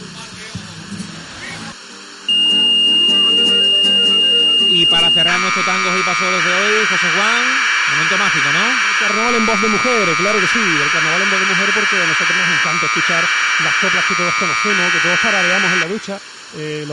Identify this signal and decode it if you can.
Commodore tape loading (standard loader), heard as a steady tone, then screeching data, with room echo.